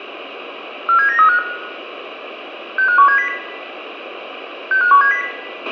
Five-tone selective call (CCIR), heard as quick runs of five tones, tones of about 100 ms, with a squelch burst at the end and room echo. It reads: 47935 65170 65170